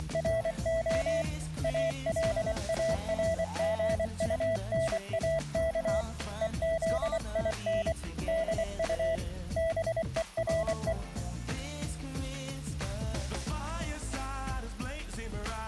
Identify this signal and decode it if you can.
Morse code, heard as a keyed tone, hand-sent with a paddle, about 24 wpm, 660 Hz. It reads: … ALARGUNAK EZIN DU BERE